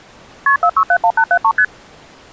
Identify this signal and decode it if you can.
Multi-frequency trunk signalling (R1, as on North American trunks), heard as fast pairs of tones, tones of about 70 ms. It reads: KP 4671873 ST